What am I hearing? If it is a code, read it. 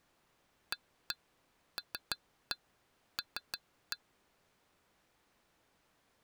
Tap code, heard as taps on glass, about 6 knocks a second. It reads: ALL